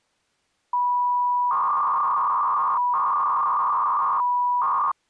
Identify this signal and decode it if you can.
300-baud modem data (V.21 tones), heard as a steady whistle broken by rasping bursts, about 300 baud, 200 Hz shift.